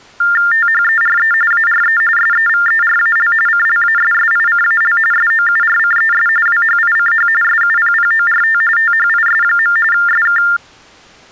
TTY/TDD text telephone tones (45.45 baud Baudot), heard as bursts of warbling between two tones, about 400 Hz shift, 1600 Hz centre. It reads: THERE ARE SEVERAL CLASSICAL SOURCES WHICH SUPPORT THIS. SK